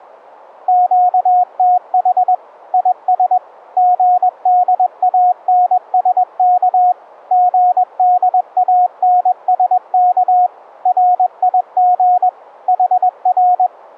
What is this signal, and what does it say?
Morse code, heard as a keyed tone, machine-sent, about 21 wpm, 720 Hz. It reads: QTH IS GDANSK GDANSK RIG HR